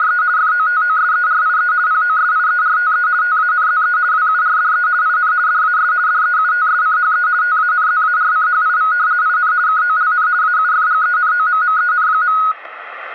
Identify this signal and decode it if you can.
RTTY (50 baud, 170 Hz shift), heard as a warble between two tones, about 1360 Hz centre, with radio static. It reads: … FOTOSERIE POSIERTE TANZE WURDE IN DAS DEUTSCHE TANZARCHIV IN KOLN AUFGENOMMEN.